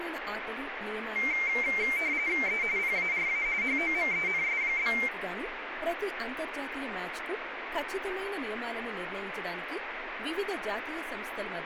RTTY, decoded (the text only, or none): E PARA HOMENS?